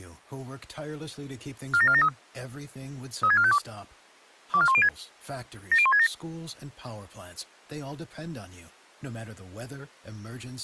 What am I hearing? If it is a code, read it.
Five-tone selective call (ZVEI), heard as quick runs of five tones, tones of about 70 ms, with speech in English. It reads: 47473 36452 24106 70167